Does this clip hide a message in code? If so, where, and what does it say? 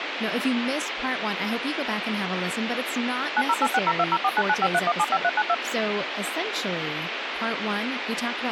Yes: DTMF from 3.4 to 5.5 s, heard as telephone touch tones, dialled by machine, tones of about 50 ms, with phone line noise and speech in English. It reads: 908602049953175392